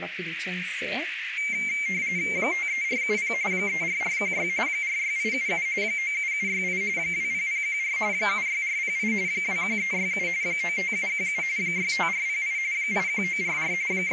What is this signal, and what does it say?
RTTY (45.45 baud, 170 Hz shift), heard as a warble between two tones, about 2200 Hz centre, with radio static, a narrow filter and speech in Italian. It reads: 53470 34416 46877 97768 20014 76408 21367 95717 65408 81944 …